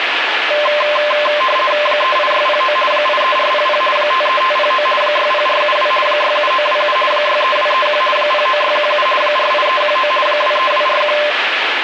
RTTY (50 baud, 450 Hz shift), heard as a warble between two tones, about 820 Hz centre, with radio static. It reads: 38609 83400 53509 60472 67927 63231 09617 48319 23241